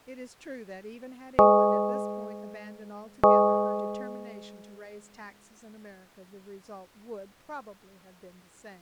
Clock strike, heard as a bell, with speech in English. 2. Two o'clock.